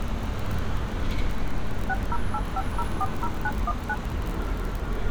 DTMF, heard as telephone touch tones, dialled by machine, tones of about 40 ms, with street noise. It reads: 6085040919